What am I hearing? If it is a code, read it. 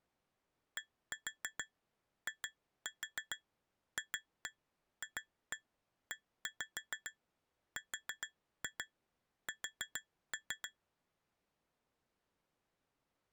Tap code, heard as taps on glass, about 6 knocks a second. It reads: DIFFERS